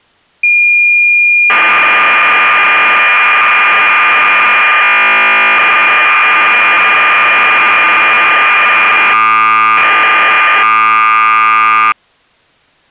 Cassette data (Kansas City type), 1200 baud, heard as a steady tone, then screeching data.